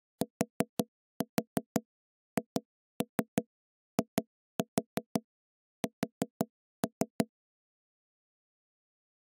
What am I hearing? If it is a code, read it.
Tap code, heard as knocks on wood, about 5 knocks a second. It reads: THIS